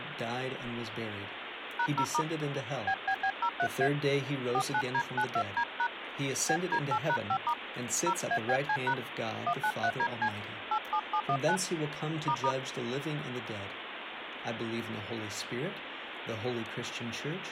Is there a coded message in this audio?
Yes: DTMF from 1.8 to 12.5 s, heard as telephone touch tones, dialled by hand, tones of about 70 ms, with phone line noise. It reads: #0* BBB03A 49D92D# BD8#5* 0ABC# 193DC 87719 **